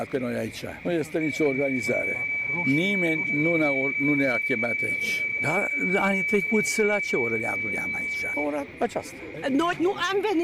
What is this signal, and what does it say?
PSK31 (31.25 baud), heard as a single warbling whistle, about 2300 Hz, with radio static and a narrow filter.